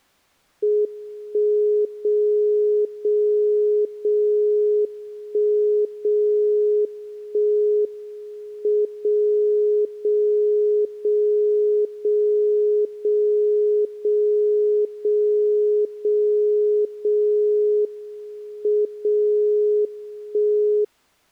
Radio time signal (WWVB), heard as a tone whose level steps once a second, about 420 Hz. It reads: 1 0 0 0 1 0 1 M 0 0 0 0 0 0 0 0 0 M 0 1